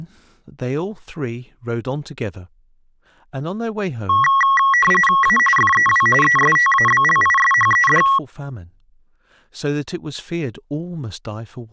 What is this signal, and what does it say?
RTTY (45.45 baud, 850 Hz shift), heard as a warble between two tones, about 1500 Hz centre, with speech in English. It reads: A FEW ESTABLISHED